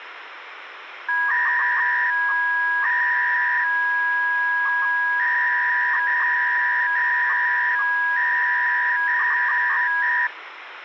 300-baud modem data (V.21 tones), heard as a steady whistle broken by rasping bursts, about 300 baud, 200 Hz shift, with phone line noise.